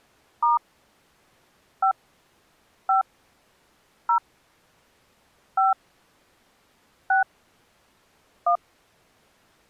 DTMF, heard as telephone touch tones, dialled by hand, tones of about 130 ms. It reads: * 5 5 0 5 6 1